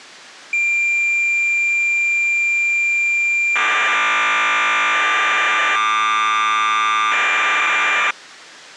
Cassette data (Kansas City type), 1200 baud, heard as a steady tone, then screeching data.